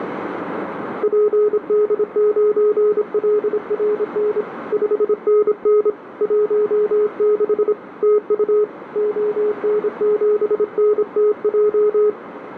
Morse code, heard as a keyed tone, hand-sent with a paddle, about 26 wpm, 420 Hz, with radio static and a narrow filter. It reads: PD9LRN 5NN 16 TU ON7NTJ